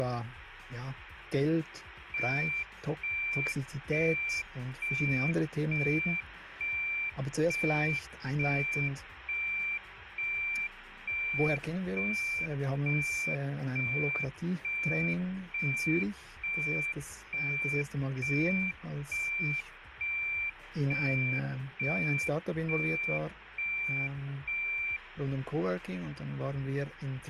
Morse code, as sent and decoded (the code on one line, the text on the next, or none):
none